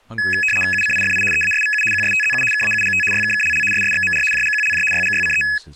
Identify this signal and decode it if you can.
RTTY (75 baud, 850 Hz shift), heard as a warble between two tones, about 2100 Hz centre, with speech in English. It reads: UCIFI EASVU QSTZU KAUGT YKKLL SSXMR JGQLJ YGYCE